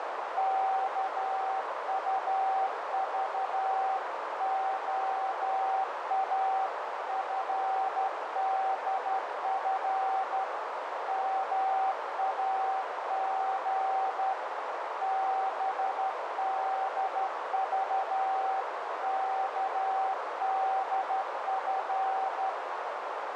Morse code (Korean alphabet), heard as a keyed tone, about 12 wpm, 770 Hz, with heavy radio static and a narrow filter. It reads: 일포는 못 들은